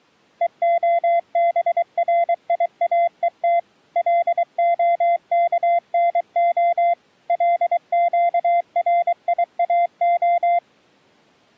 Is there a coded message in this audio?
Yes: Morse code (Hebrew alphabet) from 0.4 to 10.6 s, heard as a keyed tone, machine-sent, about 23 wpm, 690 Hz. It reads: והבריאות להכנה לקריאה